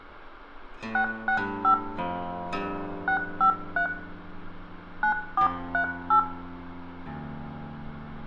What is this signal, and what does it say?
DTMF, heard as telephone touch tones, dialled by hand, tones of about 100 ms, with room echo. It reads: 665 653 9438